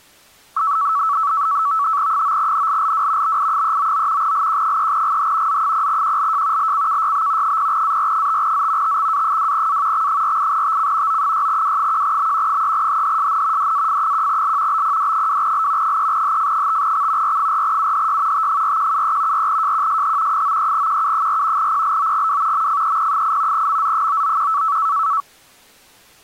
NAVTEX (SITOR-B), 100 baud, 170 Hz shift, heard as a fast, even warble, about 1220 Hz centre. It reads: 9NLLW BI399 LQ3GH Z0QLJ LCKYB 0AR5Z TXA2A X48TC O6W1B 3HHSN DAF1L BPD2L 3HF5X R4UHY T4173 4JQSH 93QU4 PLOGW MFEP8 MZ991